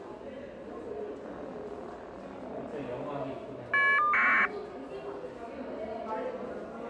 Caller ID data burst, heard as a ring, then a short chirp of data, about 1200 baud, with the noise of a subway station.